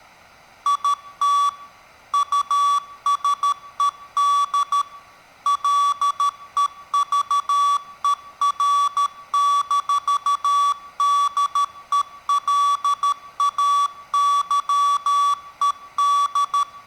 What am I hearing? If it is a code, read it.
Morse code, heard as electronic beeps, machine-sent, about 13 wpm, 1140 Hz. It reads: IT USED LEVER-DELAYED